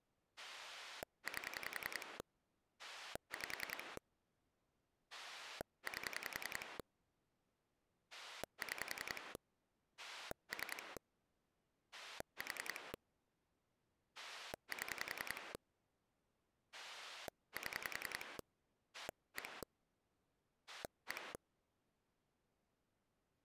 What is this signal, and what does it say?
Pulse dialling, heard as a rotary dial, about 10 pulses a second. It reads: 8 5 8 6 3 4 7 7 1 1